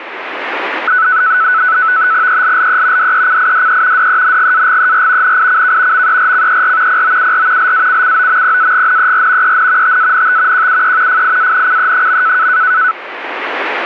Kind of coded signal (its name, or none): NAVTEX (SITOR-B)